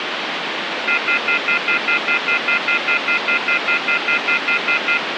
Telephone call progress tone (North American plan), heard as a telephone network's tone, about 1400, 2050, 2450, 2600 Hz, 0.1 s on and 0.1 s off, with phone line noise. Off-hook warning tone.